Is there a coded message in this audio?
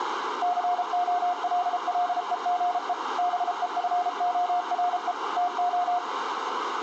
Yes: Morse code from 0.4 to 6.0 s, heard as a keyed tone, machine-sent, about 33 wpm, 710 Hz, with radio static, a narrow filter and room echo. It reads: COLLEGE BEFORE TO